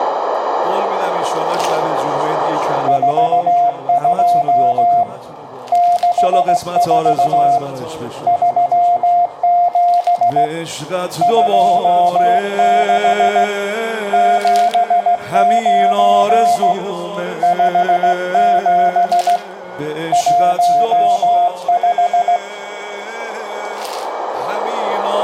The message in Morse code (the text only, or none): 42 64 37 26 79 57 15